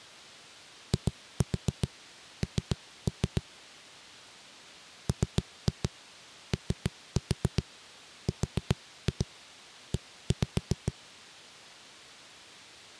Tap code, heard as knocks on a wall, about 7 knocks a second. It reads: IN MORE